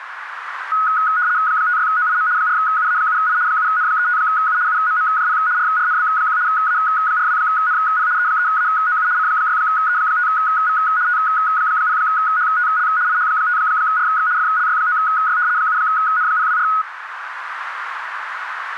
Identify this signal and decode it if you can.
RTTY (75 baud, 170 Hz shift), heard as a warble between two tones, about 1360 Hz centre, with radio static and a narrow filter. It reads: 56OIM 4UA7I 7N35U UMMJP RRNB1 A42NP E3AOU C6E5V T0HTL IH5RX FLY9Y 7N024